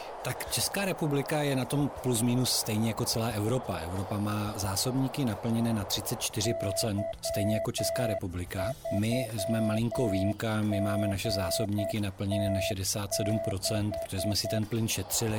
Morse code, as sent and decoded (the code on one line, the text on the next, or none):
-.-- ...-- --. - -....
Y3GT6